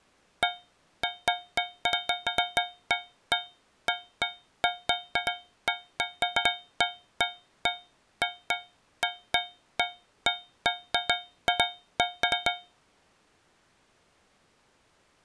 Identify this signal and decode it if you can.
Irregular taps on a metal pipe. There is no code.